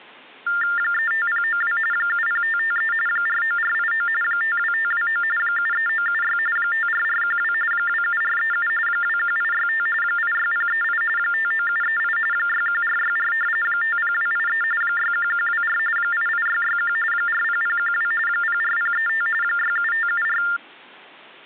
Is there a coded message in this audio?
Yes: TTY/TDD text telephone tones (45.45 baud Baudot) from 0.5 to 20.6 s, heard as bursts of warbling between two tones, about 400 Hz shift, 1600 Hz centre. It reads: 35092 70553 49489 52529 73976 54412 27437 21865 86038 59738 61464 50283 61124 88661 40012 04035 67574